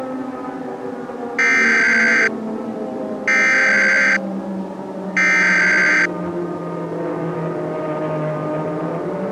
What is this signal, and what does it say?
Emergency Alert System (SAME) tones (header bursts), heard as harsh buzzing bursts, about 520.83 baud.